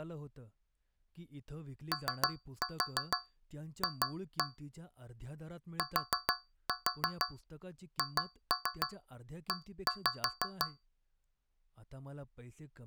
Tap code, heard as taps on a metal pipe, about 6 knocks a second, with speech in Marathi. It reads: OF THE